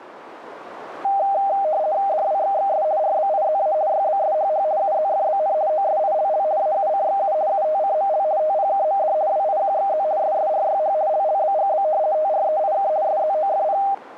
RTTY (50 baud, 170 Hz shift), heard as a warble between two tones, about 700 Hz centre, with radio static. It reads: DWXXS RBIZA YBSHH UZFBN OSILL AUCXU UTCML TPKMD WIQXZ SSRYH LLBGB TREIK SZOFP